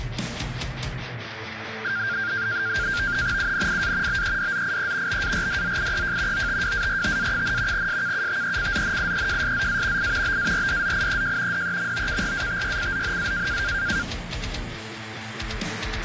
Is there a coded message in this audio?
Yes: NAVTEX (SITOR-B), 100 baud, 170 Hz shift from 1.8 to 14.0 s, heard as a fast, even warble, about 1500 Hz centre, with radio static. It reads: UNIA BEDZIE BARDZIEJ OTWARTA, SKUTECZNIEJSZA I BARDZIEJ DEMOKRATYCZNA